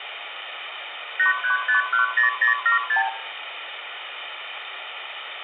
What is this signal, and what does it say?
Multi-frequency trunk signalling (R2, with the far end's replies), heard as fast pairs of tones, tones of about 120 ms, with phone line noise and room echo. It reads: 83510076